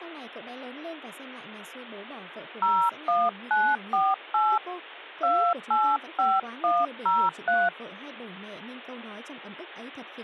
DTMF, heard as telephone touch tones, dialled by hand, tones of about 260 ms, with speech in Vietnamese. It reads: 01948 285103